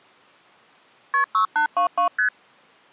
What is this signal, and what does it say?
Multi-frequency trunk signalling (R1, as on North American trunks), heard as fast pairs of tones, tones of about 100 ms. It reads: KP 6822 ST